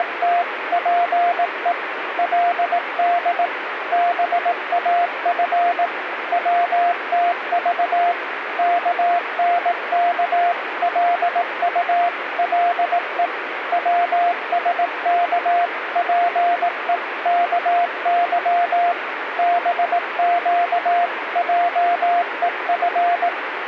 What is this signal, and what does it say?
Morse code (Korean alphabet), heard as a keyed tone, machine-sent, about 18 wpm, 700 Hz, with radio static. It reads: … 그 돈 벌 용기가 병자에 대한